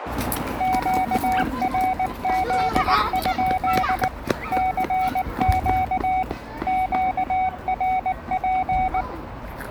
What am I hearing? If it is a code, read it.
Morse code, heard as a keyed tone, machine-sent, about 19 wpm, 750 Hz, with radio static and the noise of a park. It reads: QRZ? CQ QRP